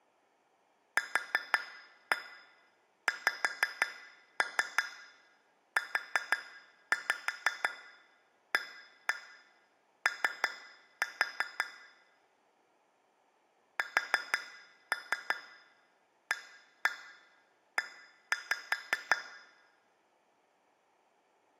Tap code, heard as taps on glass, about 5 knocks a second, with room echo. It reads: QXUAO SAE